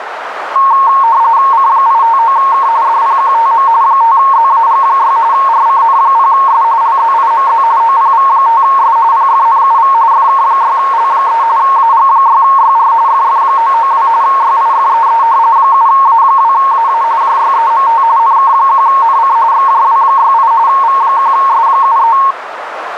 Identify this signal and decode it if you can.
RTTY (45.45 baud, 170 Hz shift), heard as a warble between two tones, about 1000 Hz centre, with radio static and a narrow filter. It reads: C859K DPQTM 5ZAG6 RCN0S LZIMZ OPV5S PFNUV FK6L3 AG6YR FF992 YIFEE 7A2AA JYEMT NK1NC XJW68 V1S73